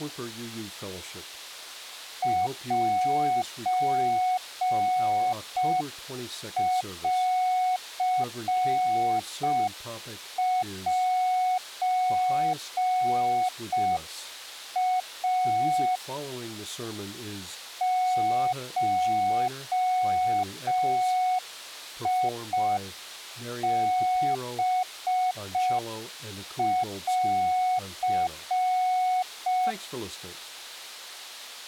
Morse code (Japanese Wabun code), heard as a keyed tone, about 5 wpm, 740 Hz. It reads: センセイ ゴハン